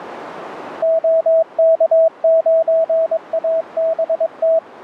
Morse code, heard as a keyed tone, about 22 wpm, 650 Hz, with radio static. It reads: OK9ABT